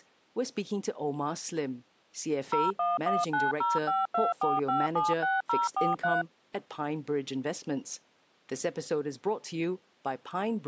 DTMF, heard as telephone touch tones, dialled by machine, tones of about 180 ms, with speech in English. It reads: 01190524576043